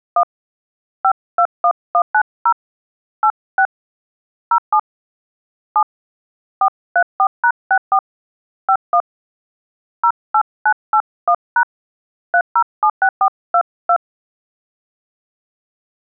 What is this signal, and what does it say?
DTMF, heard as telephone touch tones, dialled by hand, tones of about 70 ms. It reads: 1 521190 86 07 7 434#64 51 08981# 3076422